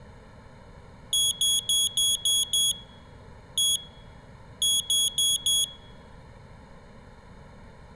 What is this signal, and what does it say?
Beep code, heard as a piezo beeper, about 3350 Hz. 6-1-4.